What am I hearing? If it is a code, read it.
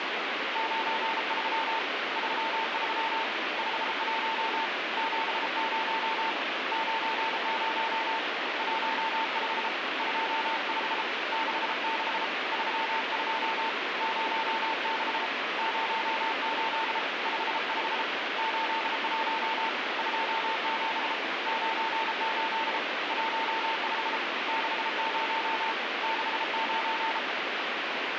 Morse code, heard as a keyed tone, hand-sent with a paddle, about 33 wpm, 900 Hz, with heavy radio static. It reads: 93 33 51 70 90 15 25 66 32 06 08 55 81 27 98 15 60 69